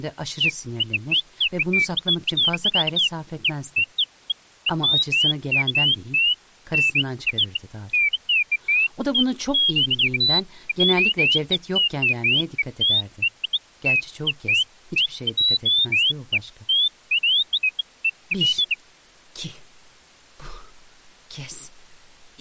Bird-like chirps, with speech in Turkish. There is no code.